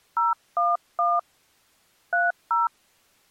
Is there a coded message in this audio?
Yes: DTMF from 0.2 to 2.7 s, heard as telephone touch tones, dialled by hand, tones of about 170 ms. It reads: 011 30